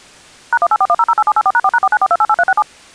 DTMF, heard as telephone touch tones, dialled by machine, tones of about 50 ms. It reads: #1841008784#4#494288367